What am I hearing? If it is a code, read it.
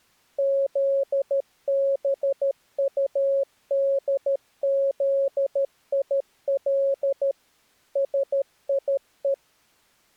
Morse code, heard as a keyed tone, machine-sent, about 13 wpm, 550 Hz. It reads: ZBUDZIL SIE